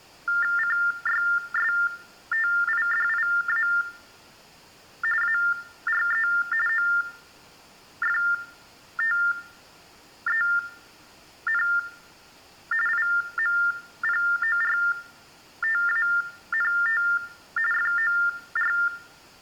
TTY/TDD text telephone tones (45.45 baud Baudot), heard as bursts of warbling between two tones, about 400 Hz shift, 1600 Hz centre. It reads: CYSTIDIA ARE OFTEN IMPORTANT FOR